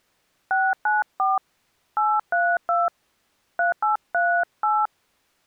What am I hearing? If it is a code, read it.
DTMF, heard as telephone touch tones, dialled by hand, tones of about 220 ms. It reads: 694 832 3838